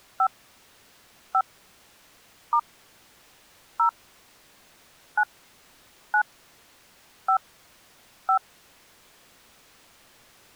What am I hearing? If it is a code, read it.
DTMF, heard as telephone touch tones, dialled by hand, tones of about 80 ms. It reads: 5 5 * 0 9 9 5 5